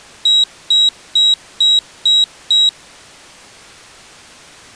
Beep code, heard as a piezo beeper, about 3850 Hz. 6 short. In AMI BIOS tables: keyboard controller gate A20 failure; in Dell tables: video card failure.